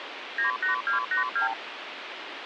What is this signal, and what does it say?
Multi-frequency trunk signalling (R2, with the far end's replies), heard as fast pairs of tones, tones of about 120 ms, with phone line noise. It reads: 98282